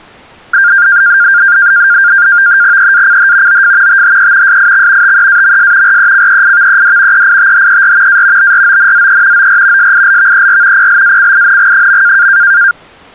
NAVTEX (SITOR-B), 100 baud, 170 Hz shift, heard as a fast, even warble, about 1500 Hz centre. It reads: EACH OF THE SIX TEAMS RECEIVED EITHER A BRONZE OR SILVER PLACING.